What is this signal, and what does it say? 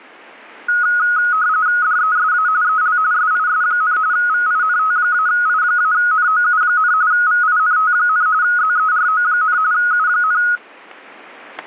RTTY (45.45 baud, 170 Hz shift), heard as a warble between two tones, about 1360 Hz centre, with static crashes. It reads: DESA EL SIS, VINT-I-NOU, VINT, ZERO, U,